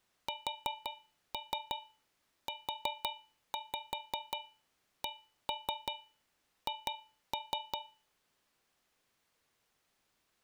Tap code, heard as taps on a metal pipe, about 5 knocks a second. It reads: SUCH